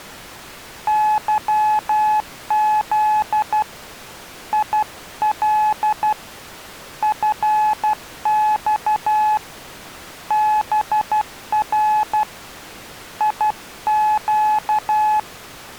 Morse code, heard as a keyed tone, hand-sent with a paddle, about 12 wpm, 850 Hz. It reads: YZ IL FX BR IQ